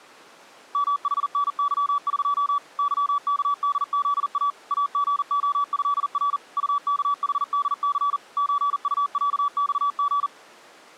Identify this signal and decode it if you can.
Morse code (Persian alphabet), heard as a keyed tone, machine-sent, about 40 wpm, 1150 Hz. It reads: محنظق ظکدزا اژعضر طکحدث چطصخژ